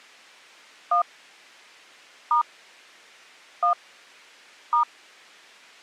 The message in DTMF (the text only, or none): 1 * 1 *